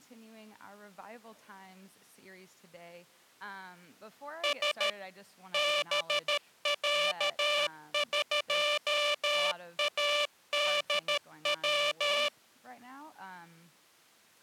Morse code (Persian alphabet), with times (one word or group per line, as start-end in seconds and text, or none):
4.4-4.9 س
5.5-12.3 بصقادو